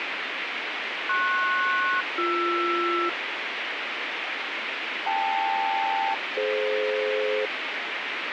Aircraft SELCAL, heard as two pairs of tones, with radio hiss. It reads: PS-BR KL-DF